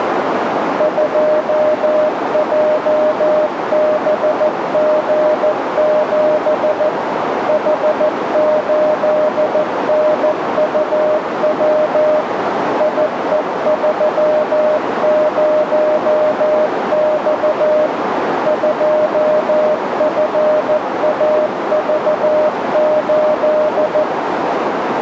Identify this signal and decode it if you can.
Morse code, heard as a keyed tone, machine-sent, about 14 wpm, 610 Hz, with radio static and a narrow filter. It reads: 2JBG7 H8NUW IE30X 2FAV8